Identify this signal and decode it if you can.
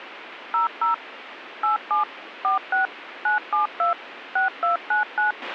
DTMF, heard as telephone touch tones, dialled by machine, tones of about 130 ms, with radio hiss and a squelch burst at the end. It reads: 00 87 46 972 6299